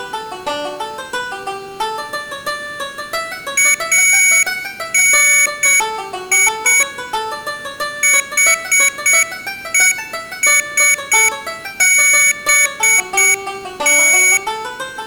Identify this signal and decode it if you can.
Morse code (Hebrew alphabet), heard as a high beeper, machine-sent, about 7 wpm, 2250 Hz. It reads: אני חושבת